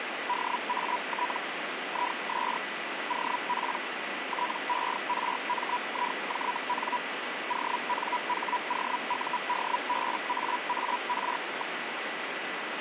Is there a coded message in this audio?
Yes: Hellschreiber (Feld-Hell, 122.5 baud) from 0.3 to 11.8 s, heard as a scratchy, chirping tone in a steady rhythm, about 980 Hz, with radio static. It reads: DAT IS OP TERMIJN ONHOUDBAAR.